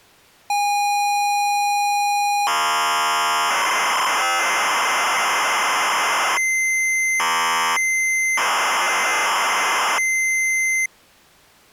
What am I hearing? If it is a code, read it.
ZX Spectrum tape loading, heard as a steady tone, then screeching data.